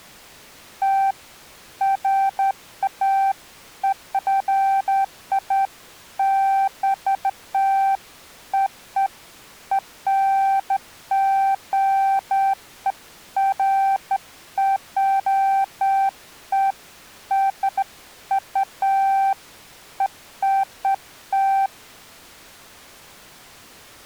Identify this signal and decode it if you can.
Beeps of irregular length. There is no code.